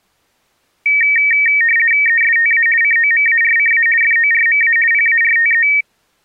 RTTY (50 baud, 450 Hz shift), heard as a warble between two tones, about 2050 Hz centre. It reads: ESTA COMARCA FORMA PARTE